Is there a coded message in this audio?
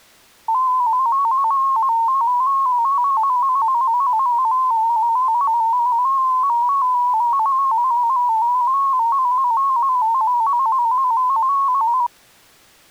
Yes: multi-tone FSK (Olivia or MFSK type), about 250 Hz wide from 0.5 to 12.1 s, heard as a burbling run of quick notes, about 15.625 baud.